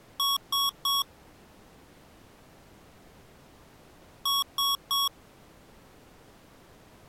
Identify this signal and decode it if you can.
Beep code, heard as beeps from a small speaker, played twice, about 1110 Hz. 3 short. In AMI BIOS tables: failure in the first 64 KB of memory; in Dell tables: chipset error.